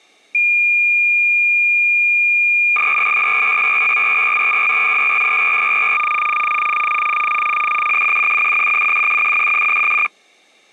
Cassette data (Kansas City type), 300 baud, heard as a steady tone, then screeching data.